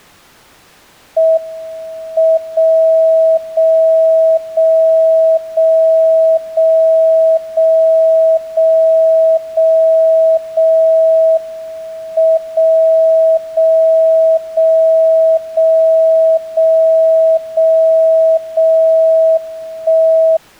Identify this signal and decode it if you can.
Radio time signal (WWVB), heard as a tone whose level steps once a second, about 650 Hz. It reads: M 0 0 0 0 0 0 0 0 0 M 0 0 0 0 0 0 0 1